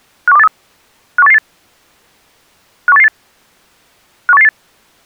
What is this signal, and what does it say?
Five-tone selective call (EEA), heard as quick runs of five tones, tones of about 40 ms. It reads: 51283 51888 51888 51888